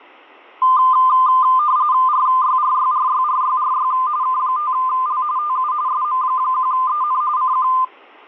RTTY (45.45 baud, 170 Hz shift), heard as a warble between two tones, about 1120 Hz centre. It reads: RYRYRYRYRY K5L TU SM1EN CQ